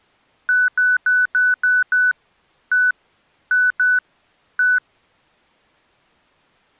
Beep code, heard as beeps from a small speaker, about 1490 Hz. 6-1-2-1.